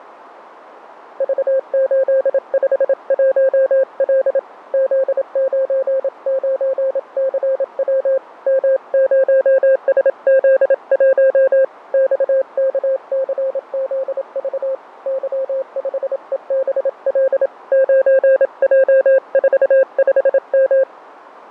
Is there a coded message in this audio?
Yes: Morse code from 1.1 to 20.9 s, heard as a keyed tone, hand-sent with a paddle, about 27 wpm, 530 Hz, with radio static and fading. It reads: V851L Z99CW M0SZ1 XKCZV Y5EBL 9J45M